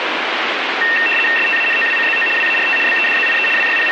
RTTY (75 baud, 850 Hz shift), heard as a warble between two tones, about 2250 Hz centre, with radio static. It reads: STANOWCZO WART BEDZIE …